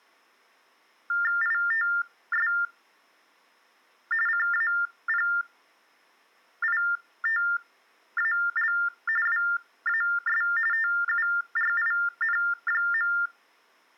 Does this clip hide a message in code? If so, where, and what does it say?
Yes: TTY/TDD text telephone tones (45.45 baud Baudot) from 1.1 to 13.3 s, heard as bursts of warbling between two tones, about 400 Hz shift, 1600 Hz centre. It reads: ITS CAPITAL WAS TURIN.